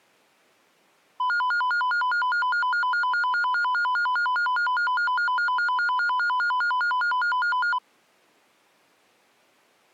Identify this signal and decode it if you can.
A tone that alternates evenly between two pitches. There is no code.